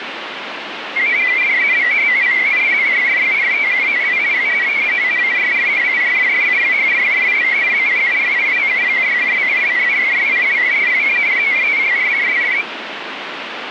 Multi-tone FSK (Olivia or MFSK type), about 500 Hz wide, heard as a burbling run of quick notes, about 62.5 baud, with radio static.